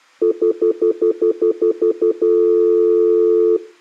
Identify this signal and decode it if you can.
Telephone call progress tone (North American plan), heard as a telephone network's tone, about 350, 440 Hz, 0.1 s on and 0.1 s off. Stutter dial tone.